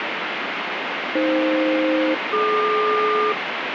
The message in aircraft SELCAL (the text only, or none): AF-DQ